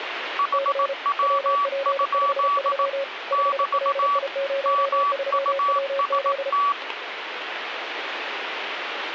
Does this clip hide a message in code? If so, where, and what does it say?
Yes: Morse code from 0.3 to 6.8 s, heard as two keyed tones, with radio static. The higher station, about 18 wpm, 1140 Hz: HW? <BT> MUST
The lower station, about 33 wpm, 550 Hz: C WP53 5LI03WZ